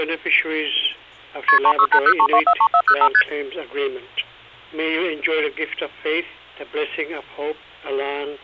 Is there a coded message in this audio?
Yes: multi-frequency trunk signalling (R1, as on North American trunks) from 1.5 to 3.2 s, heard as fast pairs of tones, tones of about 70 ms. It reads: KP 36803243405 ST